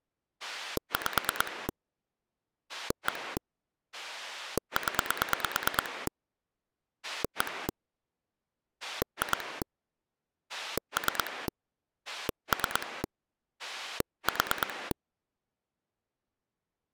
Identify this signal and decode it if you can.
Pulse dialling, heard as a rotary dial, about 9 pulses a second. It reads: 5 1 0 1 2 3 3 4